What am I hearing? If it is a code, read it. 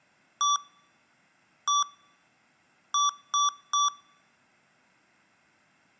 Beep code, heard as beeps from a small speaker, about 1160 Hz, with room echo. 1-1-3. In Phoenix BIOS tables: CMOS read or write failure.